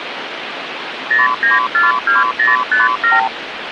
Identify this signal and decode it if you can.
Multi-frequency trunk signalling (R2, with the far end's replies), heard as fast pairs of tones, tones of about 160 ms, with phone line noise. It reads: 0942057